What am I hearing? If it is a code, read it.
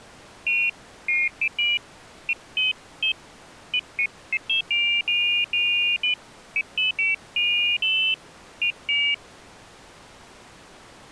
Pairs of high tones at irregular times. There is no code.